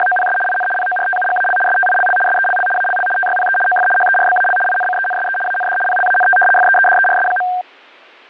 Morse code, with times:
none

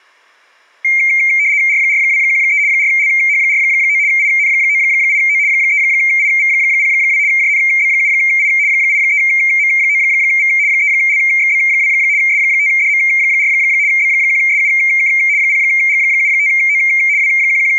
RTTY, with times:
1.7-2.6 R4213
2.7-4.0 4LH49
4.1-5.4 IN98O
5.5-7.2 3IV02
7.3-8.5 JNB7I
8.7-10.5 83M9V
10.7-11.9 3LXB2
12.2-13.5 S5DM4
13.9-15.1 B1SUK
15.4-16.8 0G75O
17.2-17.8 …

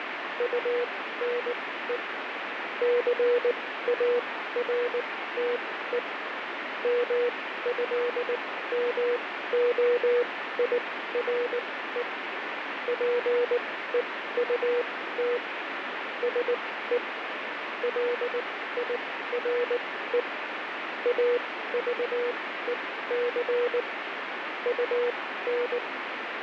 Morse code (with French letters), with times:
0.4-2.0 UNE
2.8-6.0 CARTE
6.8-12.0 MÉMOIRE
12.9-15.4 PEUT
16.2-17.0 SE
17.8-20.2 LIRE
21.1-23.8 AVEC
24.7-25.8 UN

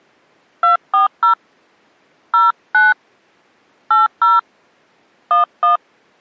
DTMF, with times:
0.6-1.3 240
2.3-2.9 09
3.9-4.4 80
5.3-5.8 11

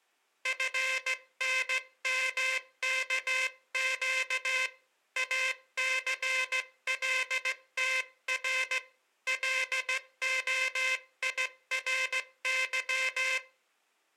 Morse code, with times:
0.5-4.7 FNMKQ
5.2-8.8 ACLTR
9.3-13.4 LOIRY

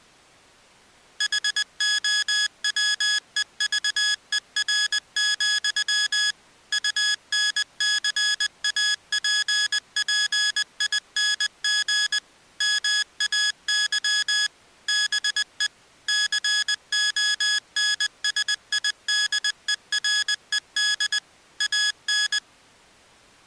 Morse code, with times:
1.2-6.3 HOWEVER,
6.7-12.2 UNCAPPING
12.6-14.5 MAY
14.9-15.7 BE
16.1-21.2 CONSIDERED
21.6-22.4 AN

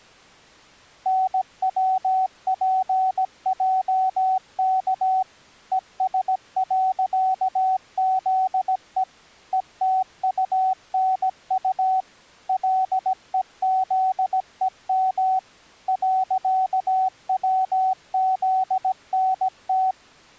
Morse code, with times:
1.1-5.2 NWPJK
5.7-9.0 ES.ZE
9.5-12.0 ETUNU
12.5-15.4 LEZEM
15.9-19.9 .WZNT

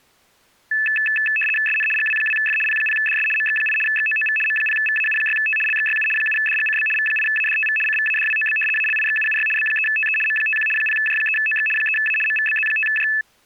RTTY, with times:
1.7-1.9 SN
2.0-2.6 GW2F
2.7-3.3 P0DS
3.4-3.8 MX8
3.9-4.4 XOOV
4.5-5.6 M0VAU6T
5.7-6.1 LXYU
6.2-6.9 7DGCB
7.0-7.8 V8ADTV
7.9-8.6 CVADWOB
8.8-9.5 ALIXUUY
9.6-10.2 B3TE
10.3-10.7 M51
10.8-11.7 0J3OX
11.8-12.2 3A
12.3-13.1 MVBZ5J

